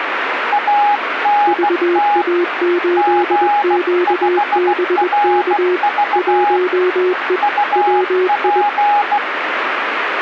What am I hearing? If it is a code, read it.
Morse code, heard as two keyed tones, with radio static. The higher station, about 16 wpm, 830 Hz: ANT G5RV UP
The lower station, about 21 wpm, 360 Hz: VA8QBK 1E WI